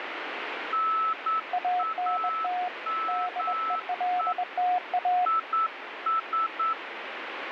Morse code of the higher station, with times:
0.7-4.3 NAME
5.3-6.7 IS

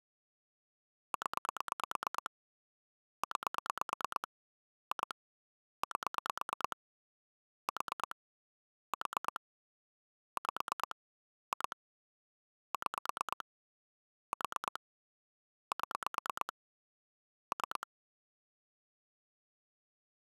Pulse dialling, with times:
1.1-2.3 0
3.2-4.3 9
4.9-5.1 2
5.8-6.8 8
7.7-8.2 4
8.9-9.4 4
10.4-11.0 5
11.5-11.8 2
12.7-13.4 6
14.3-14.8 4
15.7-16.5 7
17.5-17.9 3

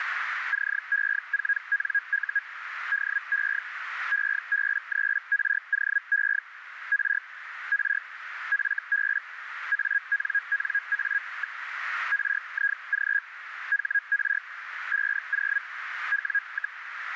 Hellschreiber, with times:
0.5-2.4 CE4NU
2.9-3.6 DE
4.1-6.4 EB3ROE
6.9-7.2 R
7.7-8.0 R
8.5-9.2 FB
9.7-11.6 ANNA.
12.1-13.2 RIG
13.7-14.4 HR
14.9-15.6 50
16.1-16.8 W,

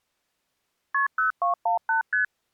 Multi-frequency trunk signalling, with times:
0.9-1.1 KP
1.2-2.0 0218
2.1-2.2 ST

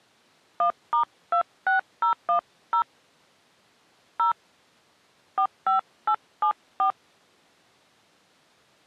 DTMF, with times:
0.6-2.8 1*26010
4.2-4.3 0
5.4-6.9 45874

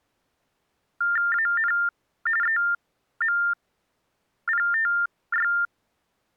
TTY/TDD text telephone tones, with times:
1.3-1.7 AN
2.4-5.5 EMPTY

